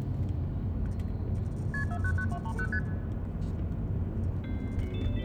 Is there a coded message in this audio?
Yes: multi-frequency trunk signalling (R1, as on North American trunks) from 1.7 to 2.8 s, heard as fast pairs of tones, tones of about 70 ms, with the noise inside a car. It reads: KP 499230 ST